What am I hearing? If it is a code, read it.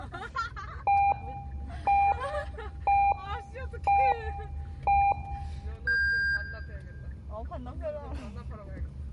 Radio time signal (five pips and a higher one, as on Chinese radio), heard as pips, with the noise inside a car.